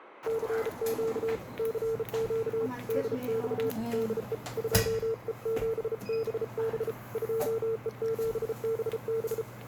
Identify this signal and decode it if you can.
Morse code, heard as a keyed tone, hand-sent with a bug key, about 34 wpm, 450 Hz, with radio static and the noise inside a lift. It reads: CQ CQ DX DE 2E7BB 2E7BB